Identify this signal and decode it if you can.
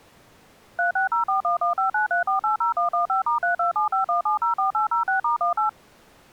DTMF, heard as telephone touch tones, dialled by machine, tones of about 120 ms. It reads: 360411593480115*32751704806*18